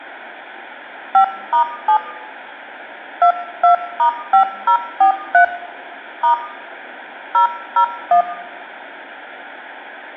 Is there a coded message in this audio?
Yes: DTMF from 1.1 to 8.2 s, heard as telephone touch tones, dialled by hand, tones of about 100 ms, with room echo. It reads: 5*7 22*5043 * 001